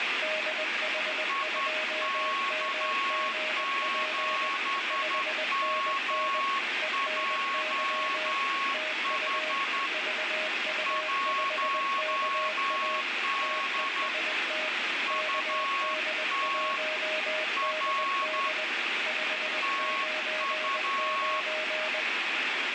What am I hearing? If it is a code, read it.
Morse code, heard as two keyed tones, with heavy radio static. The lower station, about 20 wpm, 620 Hz: DH2MGP 5NN ENY TU VU5KA TEST KD1DD 599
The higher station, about 11 wpm, 1100 Hz: IK7MJH 1D UT R TU